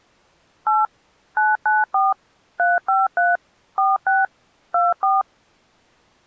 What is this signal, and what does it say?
DTMF, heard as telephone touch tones, dialled by machine, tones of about 180 ms. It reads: 8 994 353 46 24